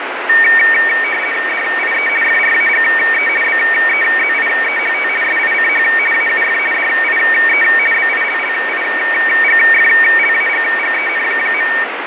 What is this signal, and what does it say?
RTTY (50 baud, 450 Hz shift), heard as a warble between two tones, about 2050 Hz centre, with radio static and fading. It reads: DIE FRAGE BEZIEHT SICH AUF DIE BILLIGFLAGGEN.